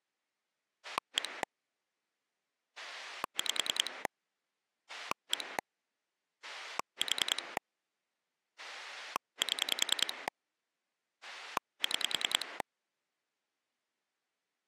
Pulse dialling, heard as a rotary dial, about 10 pulses a second. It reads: 1 5 1 4 7 6